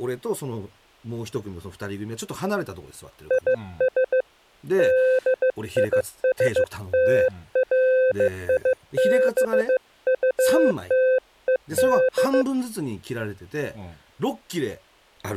Morse code, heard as a keyed tone, hand-sent with a bug key, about 15 wpm, 520 Hz, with speech in Japanese. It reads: IS DISTRIBUTED